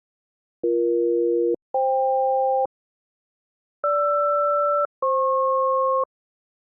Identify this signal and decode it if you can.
Aircraft SELCAL, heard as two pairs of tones. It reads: BE-FK GR-FP